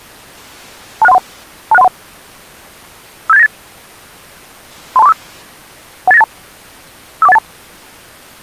Five-tone selective call (EIA), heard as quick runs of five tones, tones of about 30 ms. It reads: 26131 26131 57898 32345 18982 54182